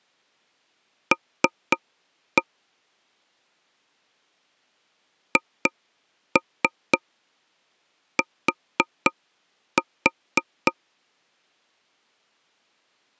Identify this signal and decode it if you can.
Tap code, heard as taps on a table, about 3 knocks a second. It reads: L HT